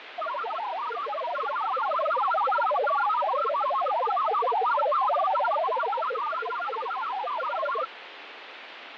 Multi-tone FSK (Olivia or MFSK type), about 1000 Hz wide, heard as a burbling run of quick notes, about 62.5 baud, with radio static and fading.